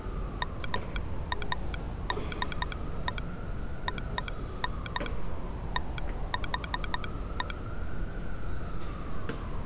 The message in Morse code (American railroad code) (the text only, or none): MADE ON THE